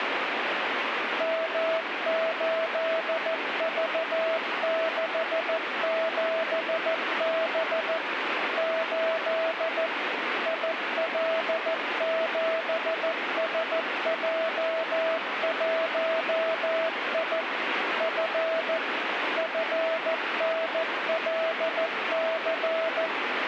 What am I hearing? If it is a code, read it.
Morse code, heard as a keyed tone, machine-sent, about 14 wpm, 650 Hz, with radio static. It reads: M8V67B 8 IL7SJ1I F FNLC